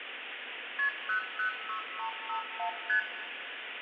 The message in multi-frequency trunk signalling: KP 006351 ST

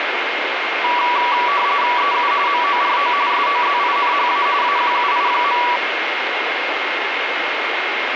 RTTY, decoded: EU MORO SOZINHA AQUI.

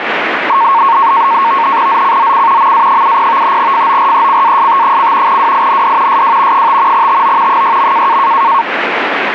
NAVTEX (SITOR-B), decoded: ZCZC MA70 FORECAST: WIND SW 5 TO 6.

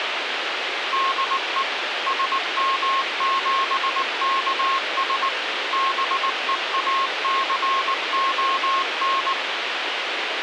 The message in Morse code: DE SM7KS BEACON

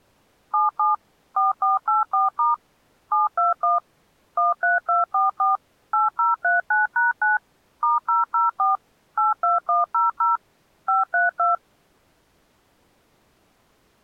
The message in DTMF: 77 4484* 721 13244 8039#9 *004 82100 532

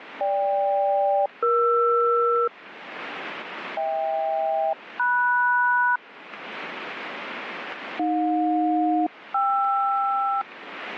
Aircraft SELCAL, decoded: GK-ER HK-MS AJ-KR

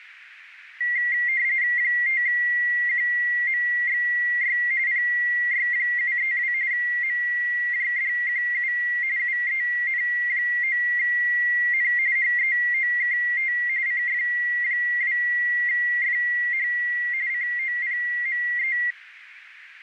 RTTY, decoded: 5QMXY PY732 MJDQU UEN9N HEOKT CF2FH COPME

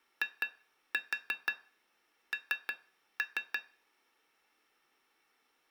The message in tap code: IN

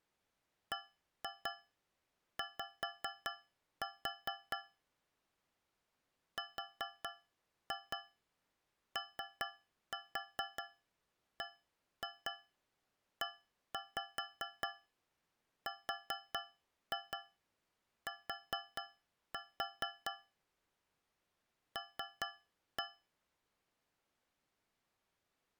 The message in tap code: BY ROBERT L

